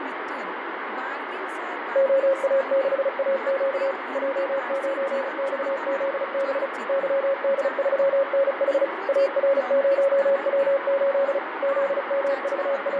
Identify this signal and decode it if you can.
Morse code, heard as a keyed tone, machine-sent, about 35 wpm, 550 Hz, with radio static, fading and speech in Santali. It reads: OA6AQ J9XZB YD3NH AR0W8 …